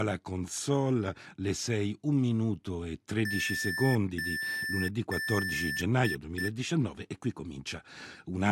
Beep code, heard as beeps from a small speaker, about 1750 Hz, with speech in Italian. 3 long, 2 short.